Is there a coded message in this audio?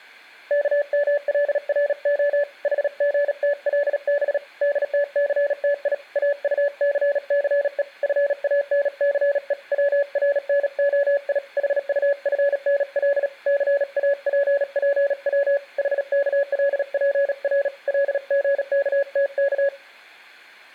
Yes: Morse code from 0.4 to 19.7 s, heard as a keyed tone, hand-sent with a paddle, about 37 wpm, 570 Hz, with room echo. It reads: KMLRO HGTLB DTCTI AUCCE FANCE WRNOI HUFNL CAPPW HKLPR LGKTK